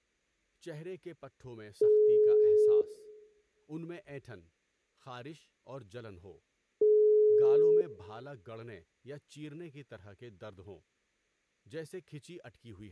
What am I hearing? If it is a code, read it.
Telephone call progress tone (single-tone plan, as in most of Europe), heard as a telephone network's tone, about 420 Hz, 1 s on and 4 s off, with room echo and speech in Urdu. Ringback tone.